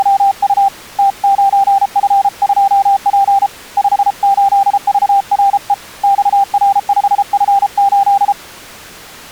Morse code, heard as a keyed tone, hand-sent with a paddle, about 33 wpm, 790 Hz. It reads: … T9F2P 58VRE XR5F8